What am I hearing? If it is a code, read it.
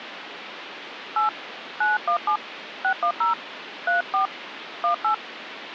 DTMF, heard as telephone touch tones, dialled by hand, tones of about 120 ms, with phone line noise. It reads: 8 917 610 34 18